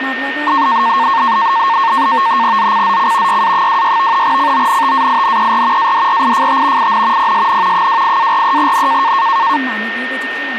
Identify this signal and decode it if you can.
NAVTEX (SITOR-B), 100 baud, 170 Hz shift, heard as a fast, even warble, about 1000 Hz centre, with radio static, a steady whistle near 1830 Hz and speech in Bodo. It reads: ZCZC YA26 CONTAINER ADRIFT IN PSN 28-43N